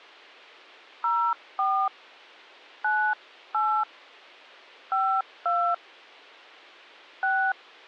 DTMF, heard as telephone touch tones, dialled by hand, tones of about 290 ms. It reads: 04 98 52 6